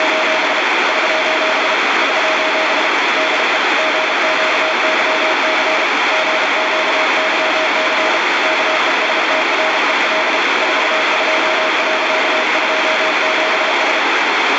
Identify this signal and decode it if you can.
Morse code, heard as a keyed tone, hand-sent with a paddle, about 33 wpm, 630 Hz, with heavy radio static. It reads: … <SOS> <SOS> DE GQYC GQYC KESTREL 42.27S